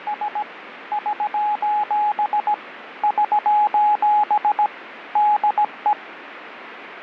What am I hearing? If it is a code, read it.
Morse code, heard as a keyed tone, machine-sent, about 17 wpm, 840 Hz, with radio static. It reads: … <SOS> <SOS> DE